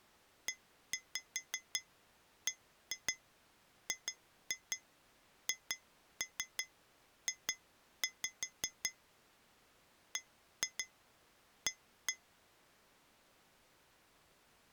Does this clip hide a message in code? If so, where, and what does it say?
Yes: tap code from 0.5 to 12.2 s, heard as taps on glass, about 5 knocks a second. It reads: EBGHJ BA